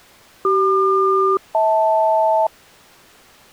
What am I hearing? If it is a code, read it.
Aircraft SELCAL, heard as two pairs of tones. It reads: CQ-HL